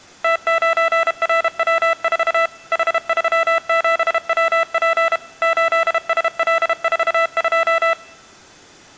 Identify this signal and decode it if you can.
Morse code, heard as electronic beeps, machine-sent, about 32 wpm, 660 Hz. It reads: T9RW4 H37WP 8SL42